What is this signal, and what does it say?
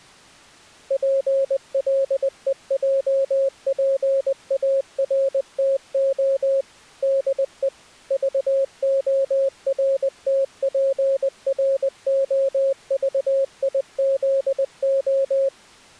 Morse code, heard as a keyed tone, machine-sent, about 20 wpm, 540 Hz. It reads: PLEJPARTO DE VORTPROVIZO